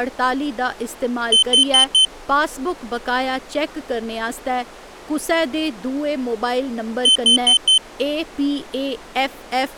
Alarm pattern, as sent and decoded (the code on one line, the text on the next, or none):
4 beeps and a pause
temporal four